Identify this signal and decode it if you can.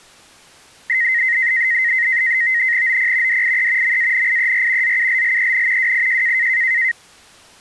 NAVTEX (SITOR-B), 100 baud, 170 Hz shift, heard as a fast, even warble, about 1950 Hz centre. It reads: OP DIE MANIER ZULLEN WIJ